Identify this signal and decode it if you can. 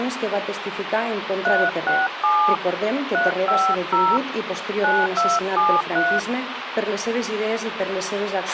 DTMF, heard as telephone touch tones, dialled by hand, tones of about 240 ms, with radio hiss and a squelch burst at the end. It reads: 367 350 9273